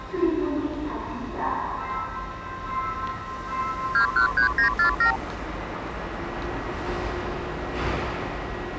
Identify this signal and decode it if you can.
Multi-frequency trunk signalling (R2, with the far end's replies), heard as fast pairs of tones, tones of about 100 ms, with the noise of a subway station. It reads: 213947